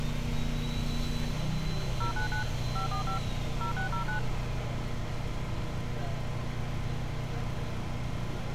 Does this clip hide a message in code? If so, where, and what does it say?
Yes: DTMF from 2.0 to 4.2 s, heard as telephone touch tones, dialled by machine, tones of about 110 ms, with street noise. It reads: 099 545 0609